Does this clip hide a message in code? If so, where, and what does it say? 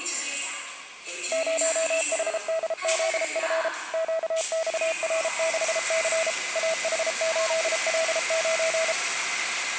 Yes: Morse code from 1.3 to 9.0 s, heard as a keyed tone, machine-sent, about 33 wpm, 650 Hz, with the noise of a subway station. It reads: 0HDZF QXR6C AH8L9